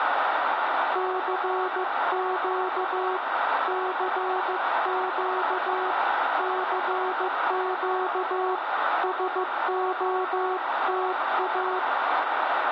Morse code, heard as a keyed tone, hand-sent with a paddle, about 15 wpm, 370 Hz, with radio static. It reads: CQ CQ CQ SOTA